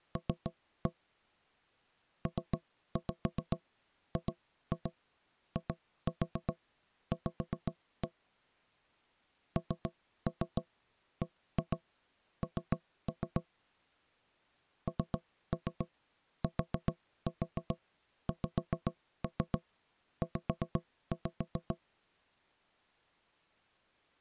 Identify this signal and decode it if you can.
Tap code, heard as knocks on wood, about 7 knocks a second. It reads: L PGIV NBN NTXZ